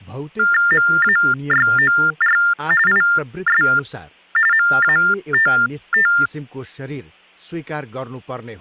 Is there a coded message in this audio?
Yes: TTY/TDD text telephone tones (45.45 baud Baudot) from 0.4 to 6.3 s, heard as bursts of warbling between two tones, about 400 Hz shift, 1600 Hz centre, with speech in Nepali. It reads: MAYOR IS MATT